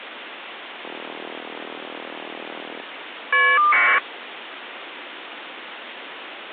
Caller ID data burst, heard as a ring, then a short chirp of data, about 1200 baud, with phone line noise.